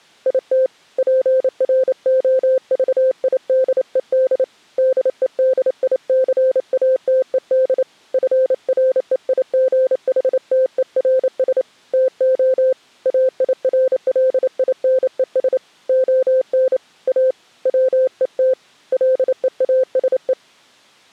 Morse code, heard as a keyed tone, hand-sent with a paddle, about 28 wpm, 520 Hz. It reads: IT PROVIDED DEDICATED FREIGHTERS TO AIRLINES ON A WET LEASE